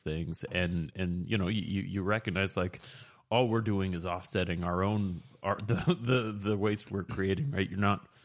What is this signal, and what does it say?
Speech in English. There is no code.